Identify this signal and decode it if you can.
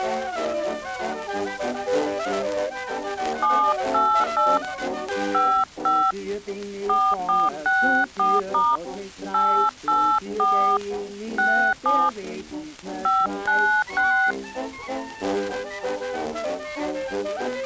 DTMF, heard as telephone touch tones, dialled by hand, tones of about 290 ms. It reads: 788 55 4464* 884 67 596